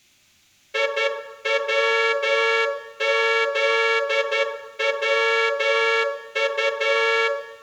Morse code, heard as a horn, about 11 wpm, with room echo. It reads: IWZWU